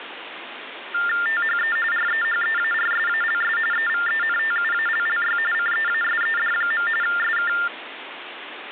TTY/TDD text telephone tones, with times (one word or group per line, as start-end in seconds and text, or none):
1.3-1.8 THE
1.9-3.6 REHEARSALS
3.7-5.4 EVENTUALLY
5.5-6.9 CEASED.
7.0-7.5 SK